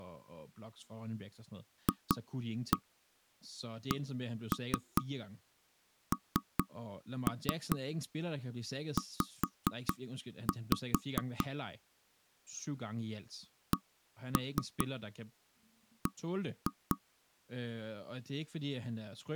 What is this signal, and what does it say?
Tap code, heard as knocks on wood, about 4 knocks a second, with speech in Danish. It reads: FCNZ CB